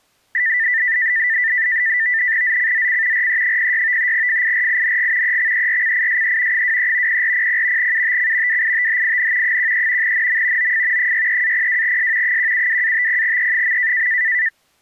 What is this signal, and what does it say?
NAVTEX (SITOR-B), 100 baud, 170 Hz shift, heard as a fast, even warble, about 1900 Hz centre. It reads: ZCZC RE06 FIRING EXERCISE 23 0400 UTC WITHIN 13 NM OF 63-02S 172-50E.